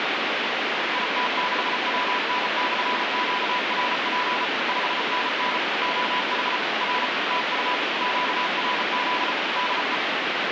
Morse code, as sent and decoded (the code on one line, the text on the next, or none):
.. - -.... .-- -. -..-. --.- .-. .--. / ..... -. -. / --- .... / .-. / - ..- / --.- .-. --.. / -.. .
IT6WN/QRP 5NN OH R TU QRZ DE